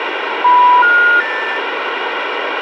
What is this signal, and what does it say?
Telephone call progress tone (North American plan), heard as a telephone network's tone, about 980, 1430, 1800 Hz, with phone line noise. Special information tone.